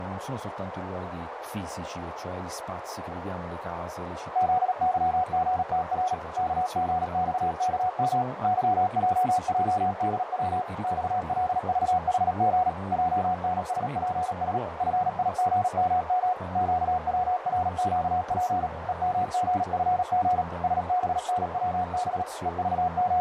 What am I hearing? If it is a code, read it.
Morse code, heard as a keyed tone, machine-sent, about 37 wpm, 730 Hz, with radio static, a narrow filter and speech in Italian. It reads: ZYGTR KGXKM YJJDW XLVHG JNSPS FIGMM QWRQP EMGFG SBNWB …